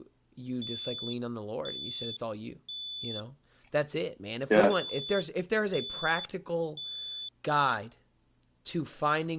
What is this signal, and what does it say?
Alarm pattern, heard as an alarm's beeps, played twice, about 3500 Hz, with speech in English. Temporal three. Smoke or fire, evacuate.